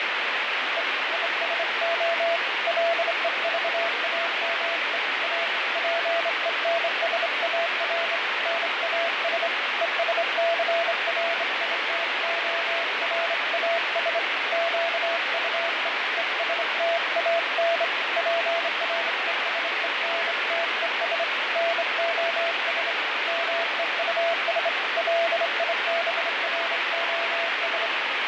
Morse code, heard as a keyed tone, hand-sent with a straight key, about 26 wpm, 670 Hz, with heavy radio static and fading. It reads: E ISO LEVAME A PENSAR NAS ESCRITORAS QUE ESTAN PRESENTES NOS MEUS LIBROS